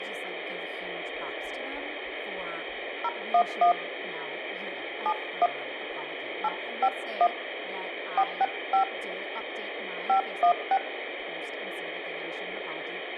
DTMF, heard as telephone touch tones, dialled by hand, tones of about 80 ms, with phone line noise and speech in English. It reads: 011 71 851 465 516